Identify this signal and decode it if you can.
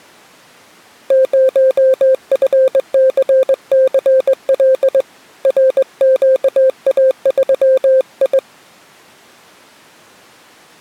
Morse code, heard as a keyed tone, hand-sent with a straight key, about 20 wpm, 520 Hz. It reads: 0FCCL RQA3I